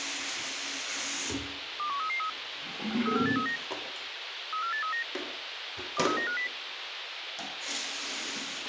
Five-tone selective call (CCIR), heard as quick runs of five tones, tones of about 100 ms, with radio hiss, a squelch burst at the end and the noise of a restroom. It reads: 21333 34839 34839 23950